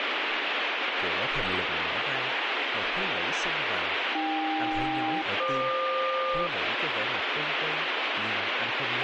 Aircraft SELCAL, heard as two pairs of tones, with radio static and speech in Vietnamese. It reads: AK-FQ